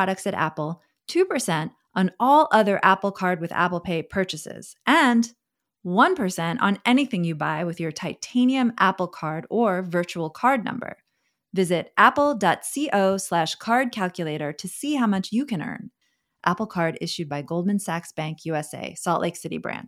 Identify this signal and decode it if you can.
Speech in English. There is no code.